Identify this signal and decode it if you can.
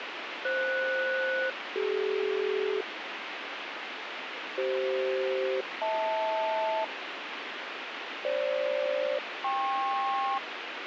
Aircraft SELCAL, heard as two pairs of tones, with radio hiss. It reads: FS-CD CF-HL FG-KP